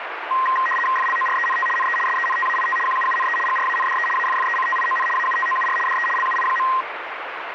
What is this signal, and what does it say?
RTTY (75 baud, 850 Hz shift), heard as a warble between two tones, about 1470 Hz centre, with radio static. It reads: FLORENT NE SENTAIT QUUNE GRANDE AFFECTION AUTOUR DE LUI.